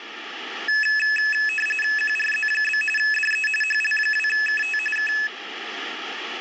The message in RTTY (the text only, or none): QRZ? DE HL2KT K